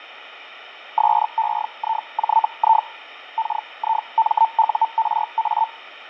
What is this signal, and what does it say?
Hellschreiber (Feld-Hell, 122.5 baud), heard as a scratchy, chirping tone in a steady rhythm, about 900 Hz, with fading. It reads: SEIJI KIMURA